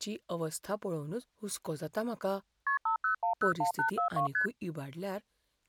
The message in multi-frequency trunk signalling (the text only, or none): KP 50101842 ST